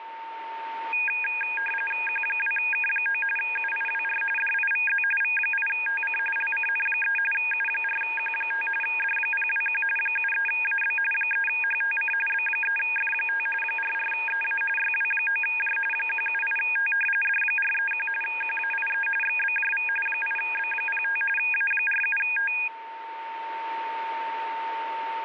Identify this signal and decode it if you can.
RTTY (45.45 baud, 850 Hz shift), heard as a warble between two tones, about 2050 Hz centre, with radio static and a steady whistle near 910 Hz. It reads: Q2K9 UIWR DIVZ V8TC LCN3 U4Q5 D021 73AB 3HTC B3F5 44EA YW9J 178T D431 QAIE XBJV 8B05 A47T